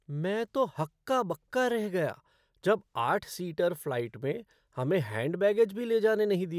Speech in Hindi. There is no code.